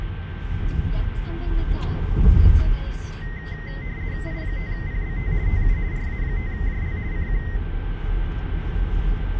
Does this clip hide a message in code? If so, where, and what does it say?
Yes: RTTY (50 baud, 170 Hz shift) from 3.2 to 7.6 s, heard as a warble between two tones, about 1950 Hz centre, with radio static, a steady whistle near 1560 Hz and the noise inside a car. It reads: I5PBT TU RA5JL CQ